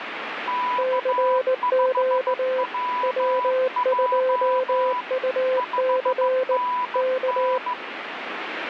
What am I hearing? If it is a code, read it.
Morse code, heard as two keyed tones, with radio static. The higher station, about 15 wpm, 990 Hz: K5WJ 5NN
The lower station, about 19 wpm, 520 Hz: CQ W2UC K